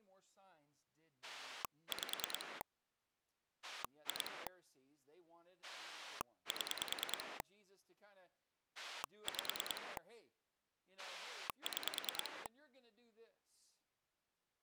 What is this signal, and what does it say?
Pulse dialling, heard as a rotary dial, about 9 pulses a second, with speech in English. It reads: 5 2 7 5 6